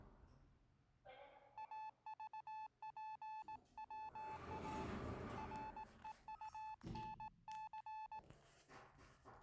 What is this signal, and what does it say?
Morse code, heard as a keyed tone, hand-sent with a straight key, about 18 wpm, 870 Hz, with the noise inside a lift. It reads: AVPWA REUNC